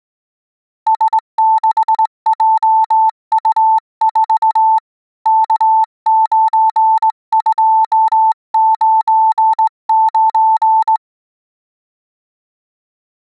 Morse code, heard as a keyed tone, hand-sent with a straight key, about 19 wpm, 880 Hz. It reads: S6JU4 K9299